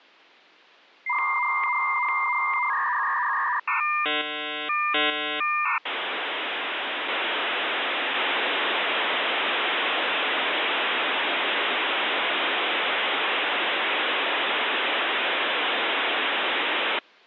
Dial-up modem handshake (V.34 or later), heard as a whistle, warbles, then hiss.